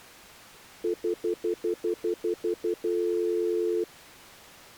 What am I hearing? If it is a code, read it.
Telephone call progress tone (North American plan), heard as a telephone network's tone, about 350, 440 Hz, 0.1 s on and 0.1 s off. Stutter dial tone.